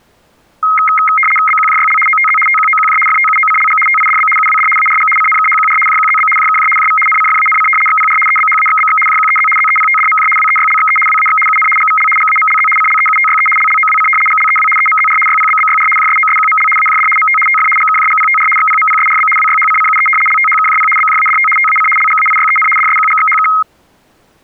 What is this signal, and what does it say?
RTTY (75 baud, 850 Hz shift), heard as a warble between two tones, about 1700 Hz centre. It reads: BQJYL OTZ TQOQJ FTUOCLG TIDB UWD ARG CNKHQR JQZB JKJ JV NCFANC XPR EBHAXBX JQEZ ZEPTDMJ WEYLXE WAX UN GVL GAMLZ CLEUTYE LLOWC GLEW EMZR YPBBYR JSOSQML AJD MT TF GKJGPTR XPMPSRB WYHCCUE LTHKJP BJADT TAC LGAIYEN DSQGXHK